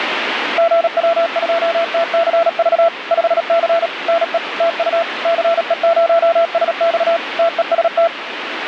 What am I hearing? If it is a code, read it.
Morse code, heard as a keyed tone, machine-sent, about 37 wpm, 670 Hz, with radio static. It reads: GW2TCV 5C NE TU CE0SX TEST